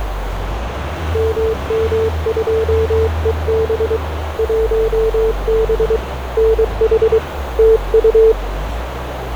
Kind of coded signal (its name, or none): Morse code